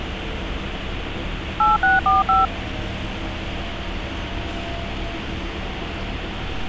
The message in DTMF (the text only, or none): 8645